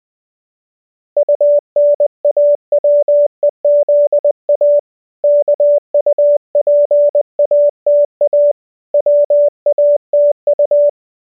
Morse code, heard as a keyed tone, hand-sent with a paddle, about 20 wpm, 580 Hz. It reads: UNAWEZA KUPATA WATU